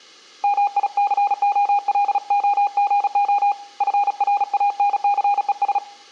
Morse code, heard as a keyed tone, hand-sent with a paddle, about 36 wpm, 810 Hz, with room echo. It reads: MICOLOGO FRANCES